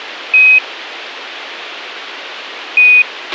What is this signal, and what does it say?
Quindar tones, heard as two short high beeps, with a squelch burst at the end.